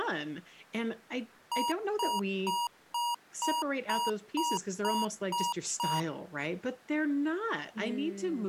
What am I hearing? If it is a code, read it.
Beep code, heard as beeps from a small speaker, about 950 Hz, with speech in English. 10 short. In AMI BIOS tables: CMOS shutdown register error.